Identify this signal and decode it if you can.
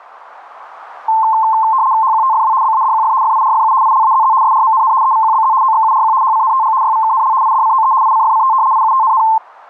RTTY (75 baud, 170 Hz shift), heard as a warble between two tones, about 970 Hz centre. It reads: HQTFW BADQF FIRFU ILAZZ SRMNN EVQBZ OXURQ HCNTG YVKNL IDCOE ICFCT IUTNN